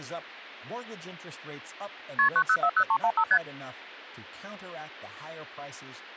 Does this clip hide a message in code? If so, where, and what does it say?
Yes: multi-frequency trunk signalling (R1, as on North American trunks) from 2.2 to 3.4 s, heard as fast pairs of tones, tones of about 70 ms, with speech in English. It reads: KP 9040315 ST